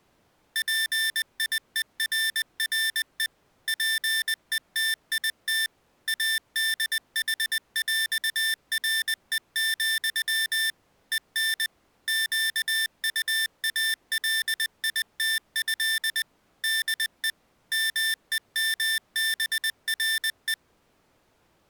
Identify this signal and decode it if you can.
Morse code (with French letters), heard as electronic beeps, machine-sent, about 20 wpm, 1800 Hz. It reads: PIERRE PETIT ADHÈRE, EN QUALITÉ DE MEMBRE